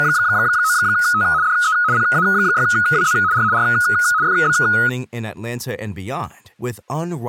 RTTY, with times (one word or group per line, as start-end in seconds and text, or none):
0.0-1.2 …
1.4-1.7 DE
1.9-3.1 PA6WZ
3.3-3.4 R
3.5-3.6 R
4.2-4.5 FB